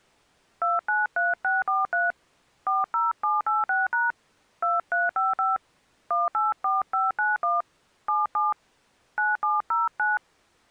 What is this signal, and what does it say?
DTMF, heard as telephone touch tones, dialled by hand, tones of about 180 ms. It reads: 293643 40786# 2355 184591 77 9709